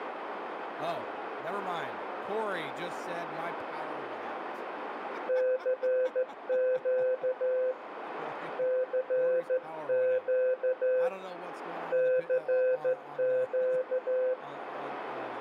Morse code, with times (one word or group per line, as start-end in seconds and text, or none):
5.3-7.7 CQ
8.6-11.1 CQ
11.9-14.3 CQ